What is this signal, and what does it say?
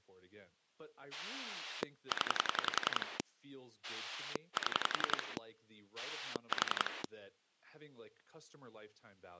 Pulse dialling, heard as a rotary dial, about 11 pulses a second, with speech in English. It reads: 0 7 4